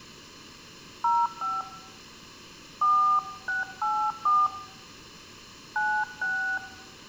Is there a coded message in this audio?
Yes: DTMF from 1.0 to 6.6 s, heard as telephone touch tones, dialled by hand, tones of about 270 ms. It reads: 05 4684 96